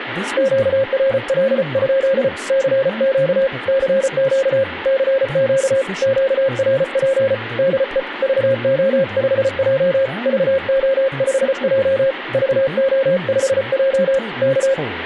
Morse code, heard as a keyed tone, hand-sent with a paddle, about 34 wpm, 540 Hz, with radio static, room echo and speech in English. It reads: QRL? CQ CQ CQ QRP DE VO5J VO5J VO5J K